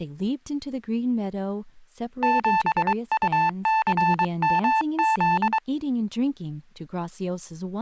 Morse code, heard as a keyed tone, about 23 wpm, 880 Hz, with speech in English. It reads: 7UCMZ